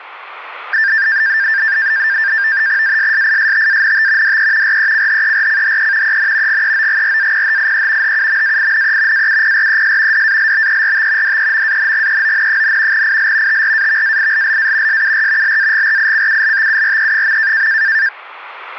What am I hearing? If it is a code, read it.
NAVTEX (SITOR-B), 100 baud, 170 Hz shift, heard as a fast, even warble, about 1700 Hz centre. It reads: ASSISTANT DE RECHERCHE EN GEOGRAPHIE HUMAINE AUPRES DALBERT DEMANGEON, IL TRAVAILLA SUR LAGRICULTURE.